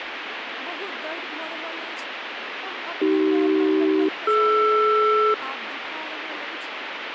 Aircraft SELCAL, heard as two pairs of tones, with radio static and speech in Maithili. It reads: AC-DR